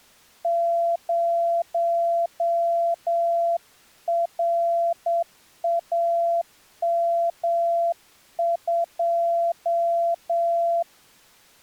Morse code, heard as a keyed tone, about 8 wpm, 680 Hz. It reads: 0RAM2